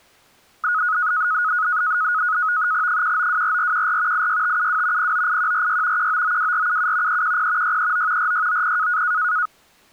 NAVTEX (SITOR-B), 100 baud, 170 Hz shift, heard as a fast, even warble, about 1360 Hz centre. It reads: 1924414 86572 098146 1992477 310 639 4690